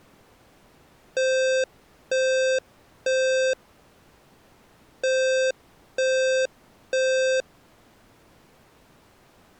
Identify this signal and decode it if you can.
Alarm pattern, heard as an alarm's beeps, played twice, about 520 Hz. Temporal three. Smoke or fire, evacuate.